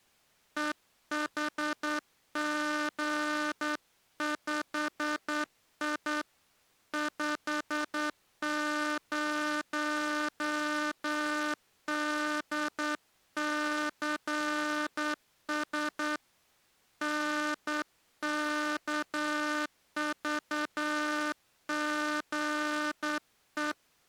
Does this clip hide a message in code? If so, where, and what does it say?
Yes: Morse code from 0.5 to 23.8 s, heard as a buzzer, hand-sent with a straight key, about 9 wpm. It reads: EHG5I 50DCS NKVGE